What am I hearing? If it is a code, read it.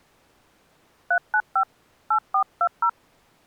DTMF, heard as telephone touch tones, dialled by hand, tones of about 80 ms. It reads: 395 8420